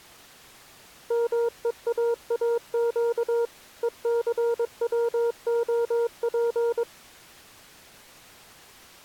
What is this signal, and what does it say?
Morse code (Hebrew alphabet), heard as a keyed tone, machine-sent, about 22 wpm, 470 Hz. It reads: מואאק וסצהף